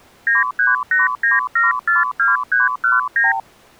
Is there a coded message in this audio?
Yes: multi-frequency trunk signalling (R2, with the far end's replies) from 0.3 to 3.4 s, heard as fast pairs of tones, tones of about 160 ms. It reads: 9389742319